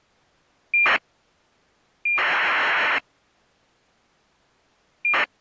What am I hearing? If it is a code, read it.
ACARS aircraft data, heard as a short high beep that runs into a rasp, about 2400 baud.